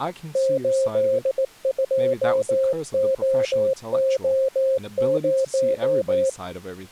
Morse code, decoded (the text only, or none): 82OO0